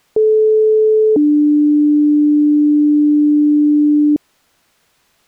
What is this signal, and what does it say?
Two-tone page, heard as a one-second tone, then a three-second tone, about 430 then 300 Hz.